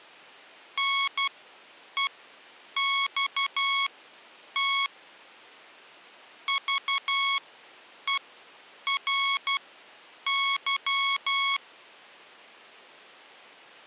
Morse code, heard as electronic beeps, machine-sent, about 12 wpm, spaced as for 8 wpm, 1100 Hz. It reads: NEXT VERY